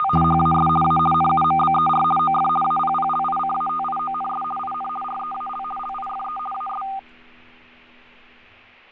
RTTY (50 baud, 450 Hz shift), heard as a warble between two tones, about 1000 Hz centre, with fading. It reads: … HAS A NUMBER OF APPLICATIONS IN REAL LIFE AS